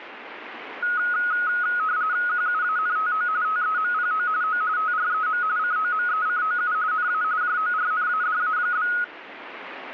RTTY (45.45 baud, 170 Hz shift), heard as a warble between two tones, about 1360 Hz centre, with radio static. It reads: QUANTO TEMPO O TREM COMECOU NA JORNADA?